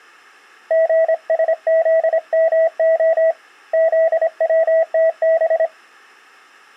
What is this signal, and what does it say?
Morse code, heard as a keyed tone, hand-sent with a straight key, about 26 wpm, 650 Hz. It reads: GSZMO ZWTB